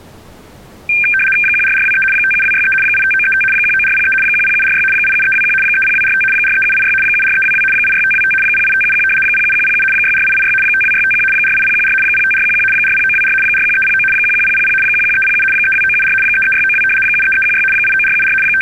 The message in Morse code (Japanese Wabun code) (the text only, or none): none